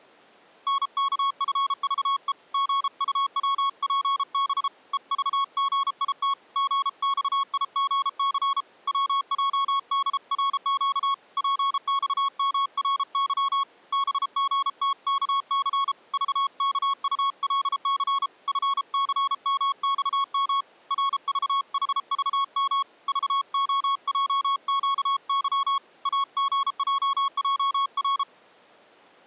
Morse code, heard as a keyed tone, hand-sent with a paddle, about 33 wpm, 1100 Hz. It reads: NKFVE GUWPB EVGIT GXIGC WJDRQ PXMRY BGTKC VKULC FCMXM RVHVM VOJQY AGJJR